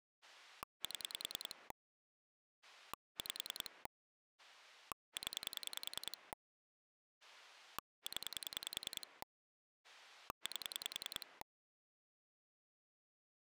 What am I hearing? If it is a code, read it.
Pulse dialling, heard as a rotary dial, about 10 pulses a second. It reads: 7 5 0 0 8